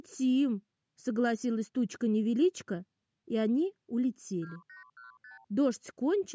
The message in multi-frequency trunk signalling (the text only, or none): 2815